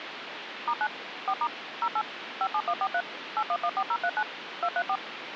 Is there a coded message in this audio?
Yes: DTMF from 0.7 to 5.0 s, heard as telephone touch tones, dialled by machine, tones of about 60 ms, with phone line noise. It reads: *9 4* 08 57143 8114039 234